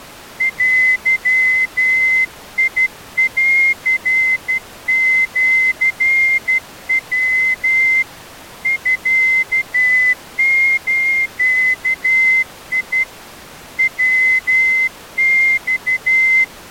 Morse code (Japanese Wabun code), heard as a whistle, hand-sent with a straight key, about 12 wpm. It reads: デンシヤ ミズ ヤマ